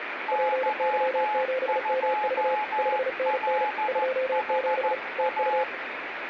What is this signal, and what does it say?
Morse code, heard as two keyed tones, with radio static. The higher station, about 14 wpm, 850 Hz: Y2LHA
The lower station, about 35 wpm, 520 Hz: PY7MV 5NN 27 TU